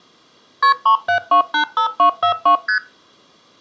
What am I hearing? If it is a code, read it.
Multi-frequency trunk signalling (R1, as on North American trunks), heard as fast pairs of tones, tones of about 100 ms, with room echo. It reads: KP 37285242 ST